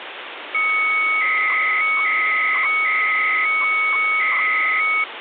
300-baud modem data (Bell 103 tones), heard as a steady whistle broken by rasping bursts, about 300 baud, 200 Hz shift, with phone line noise.